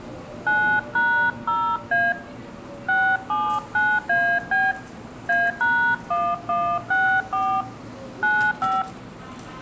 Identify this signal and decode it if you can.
DTMF, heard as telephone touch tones, dialled by hand, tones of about 280 ms, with room echo and the noise of a subway station. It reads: 9#0A 679AB A#1164 95